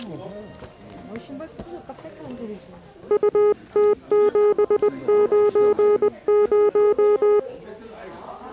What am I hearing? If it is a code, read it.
Morse code, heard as a keyed tone, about 20 wpm, 420 Hz, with the noise of a crowd indoors. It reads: UT790